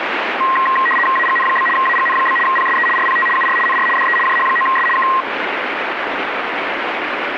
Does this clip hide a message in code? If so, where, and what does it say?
Yes: RTTY (75 baud, 850 Hz shift) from 0.4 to 5.2 s, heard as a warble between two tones, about 1480 Hz centre, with radio static. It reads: AGN? AGN? PSE RPT UR NR DE JH9S K